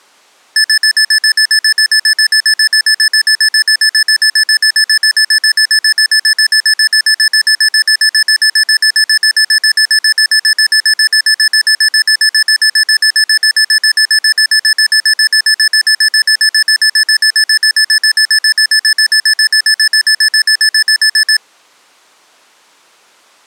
Evenly repeated beeps. There is no code.